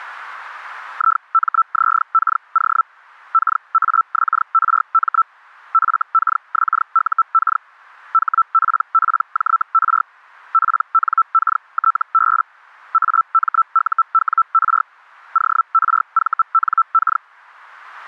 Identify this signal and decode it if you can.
Hellschreiber (Feld-Hell, 122.5 baud), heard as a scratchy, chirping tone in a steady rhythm, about 1330 Hz. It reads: IMZKO KAXRM FKXUK HPPJR PNKTB AMUWR ORVNK